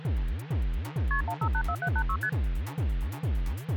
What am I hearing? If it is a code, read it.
Multi-frequency trunk signalling (R1, as on North American trunks), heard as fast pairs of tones, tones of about 70 ms. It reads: KP 1584786 ST